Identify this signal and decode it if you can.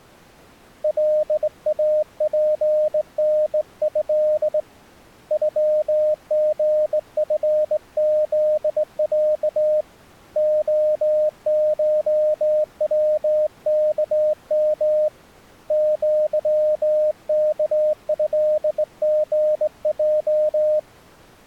Morse code (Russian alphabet), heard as a keyed tone, hand-sent with a straight key, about 19 wpm, 610 Hz. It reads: ЛАПНЭ ЮГФЗЯ ОШВКМ ЪКЭГЙ